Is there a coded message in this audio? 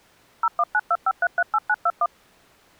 Yes: DTMF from 0.4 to 2.1 s, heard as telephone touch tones, dialled by machine, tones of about 50 ms. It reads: 01925338921